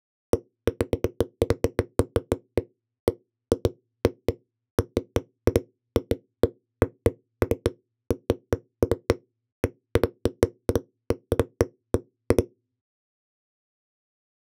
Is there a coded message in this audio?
No, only irregular knocks on a wall.